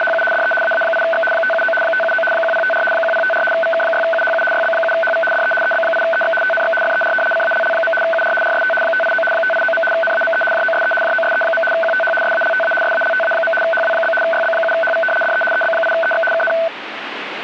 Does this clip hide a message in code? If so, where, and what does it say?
Yes: RTTY (75 baud, 850 Hz shift) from 0.0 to 16.7 s, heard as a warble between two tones, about 1080 Hz centre, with radio static. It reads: … DE AA8X 579 579 1054 1054 VK6UHU YB7HV DE EB8EX TNX FER CALL. UR RST 589 589. NAME JOSE JOSE. QTH SALTA SALTA. HW? YB7HV DE EB8EX KN